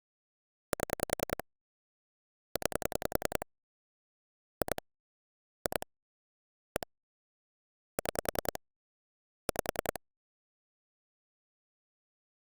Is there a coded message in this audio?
Yes: pulse dialling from 0.7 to 10.0 s, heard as clicks on a phone line, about 10 pulses a second. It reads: 7 9 2 2 1 6 5